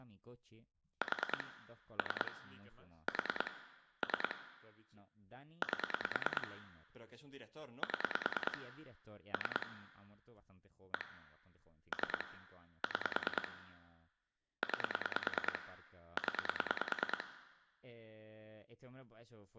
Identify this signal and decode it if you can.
Pulse dialling, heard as clicks on a phone line, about 9 pulses a second, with room echo and speech in Spanish. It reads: 4 3 4 3 8 7 3 1 3 6 9 0